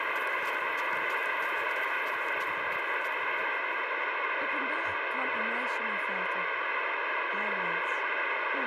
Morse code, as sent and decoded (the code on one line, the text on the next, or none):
--.- .-. .-.. ..--..
QRL?